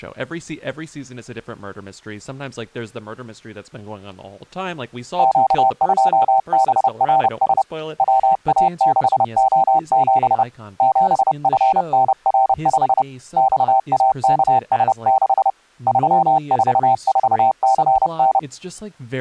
Morse code, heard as a keyed tone, hand-sent with a paddle, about 30 wpm, 780 Hz, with speech in English. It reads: Q2BRS WA6O7 7FNR5 XAKS6 344CN